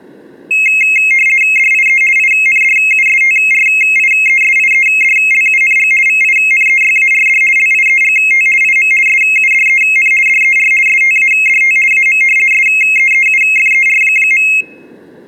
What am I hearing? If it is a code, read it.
RTTY (50 baud, 450 Hz shift), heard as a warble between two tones, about 2350 Hz centre, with room echo. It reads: DIE INDUSTRIESIEDLUNG VINEYARD LIEGT IM SUDEN DER STADT AM SEEUFER.